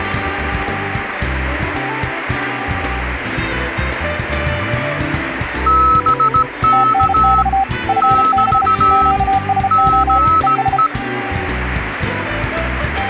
Morse code, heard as two keyed tones, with radio static. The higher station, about 17 wpm, 1300 Hz: BK <BT> GE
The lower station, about 33 wpm, 780 Hz: TNX FB QSO ES